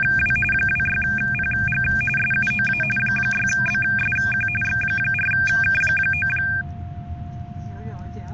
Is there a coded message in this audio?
Yes: RTTY (45.45 baud, 850 Hz shift) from 0.0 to 6.6 s, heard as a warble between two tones, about 2000 Hz centre, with a steady whistle near 700 Hz and the noise inside a car. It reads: … 26PG SUOA 6BSQ X4K9